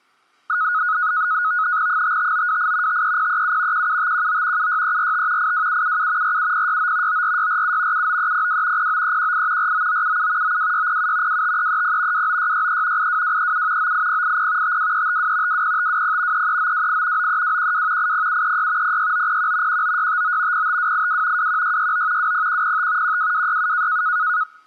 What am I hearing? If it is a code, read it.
NAVTEX (SITOR-B), 100 baud, 170 Hz shift, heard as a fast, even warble, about 1360 Hz centre. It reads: 55928 53037 17519 76345 82777 47069 94647 79302 09318 49977 92607 25330 29663 82237 98080 52352 20520 33928 93212 80736 06901 19659 05282 21669 20105 12267